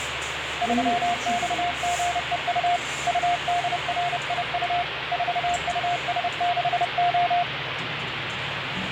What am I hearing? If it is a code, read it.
Morse code, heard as a keyed tone, hand-sent with a paddle, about 30 wpm, 700 Hz, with radio static and the noise inside a lift. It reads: 3XGEU UDRIU 4US6O